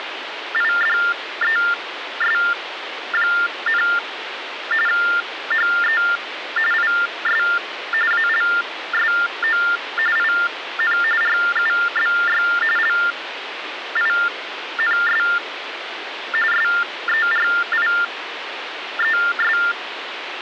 TTY/TDD text telephone tones (45.45 baud Baudot), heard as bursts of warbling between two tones, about 400 Hz shift, 1600 Hz centre, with phone line noise. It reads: … HE IS ALSO IN RUBY LINS SERIES